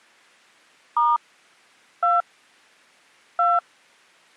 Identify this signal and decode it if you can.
DTMF, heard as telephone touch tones, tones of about 190 ms. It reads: * 2 2